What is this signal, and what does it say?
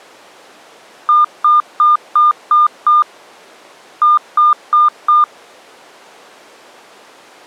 Beep code, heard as beeps, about 1210 Hz. 6-4.